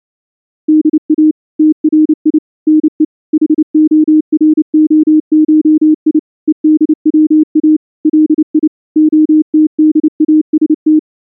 Morse code (Russian alphabet), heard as a keyed tone, machine-sent, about 29 wpm, 310 Hz. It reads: ДА ТРИ НЕ ХОРОШИ ЕДВА ЛИ ОТДАСТ